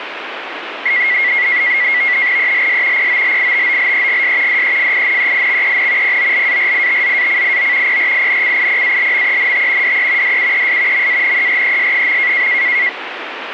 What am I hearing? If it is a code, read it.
NAVTEX (SITOR-B), 100 baud, 170 Hz shift, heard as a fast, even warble, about 2050 Hz centre, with radio static. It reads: ELS POLITOLEGS DEFINEIXEN POLARITZACIO PRINCIPALMENT DE DUES MANERES.